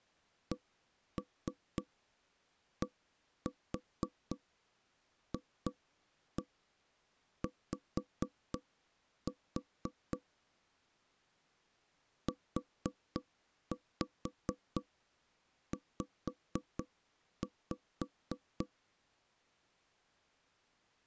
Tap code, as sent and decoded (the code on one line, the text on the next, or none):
1-3 1-4 2-1 5-4 / 4-5 5-5
CDFY UZ